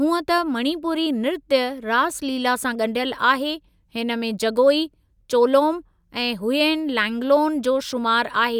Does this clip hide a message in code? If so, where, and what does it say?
No, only speech in Sindhi.